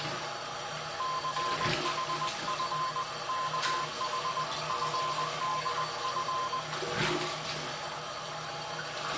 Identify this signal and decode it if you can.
Morse code (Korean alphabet), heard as a keyed tone, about 20 wpm, 1040 Hz, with the noise of a restroom. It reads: 춘우는